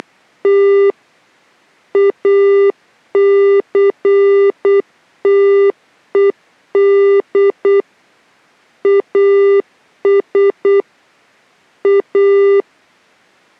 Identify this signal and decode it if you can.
Morse code, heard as electronic beeps, machine-sent, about 8 wpm, 400 Hz. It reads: … ACTED AS A